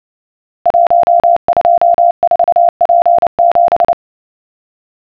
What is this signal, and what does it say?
Morse code, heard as a keyed tone, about 29 wpm, 690 Hz. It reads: 124P7